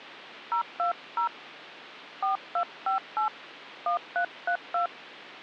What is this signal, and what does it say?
DTMF, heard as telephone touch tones, dialled by hand, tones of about 110 ms. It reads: 020 4258 1332